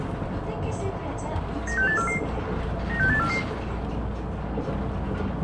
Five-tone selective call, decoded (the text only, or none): 96844 96844